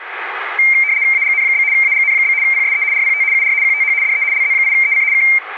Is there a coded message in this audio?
Yes: RTTY (75 baud, 170 Hz shift) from 0.6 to 5.4 s, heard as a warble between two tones, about 2200 Hz centre, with radio static. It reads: AGN? AGN? PSE RPT UR QTH DE LZ8EC K